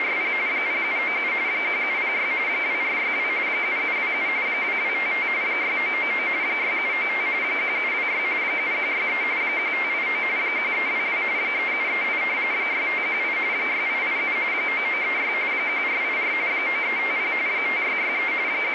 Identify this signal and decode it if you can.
RTTY (45.45 baud, 170 Hz shift), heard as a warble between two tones, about 2200 Hz centre, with radio static. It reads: … 0797 1706 2462 7727 2255 6999 6795 1726 7163 1589 1322 3738 6518 6887 9936 1484 9350 5663 …